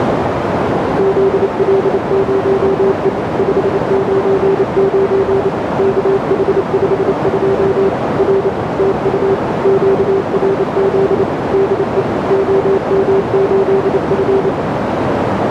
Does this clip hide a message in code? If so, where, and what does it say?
Yes: Morse code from 0.9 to 14.5 s, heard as a keyed tone, machine-sent, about 28 wpm, 390 Hz, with heavy radio static and a narrow filter. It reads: ZL0E 599 KH52 R TU QRZ DE OM8F